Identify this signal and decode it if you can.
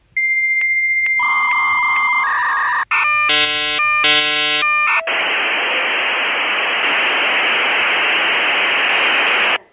Dial-up modem handshake (V.34 or later), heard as a whistle, warbles, then hiss, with the noise inside a lift.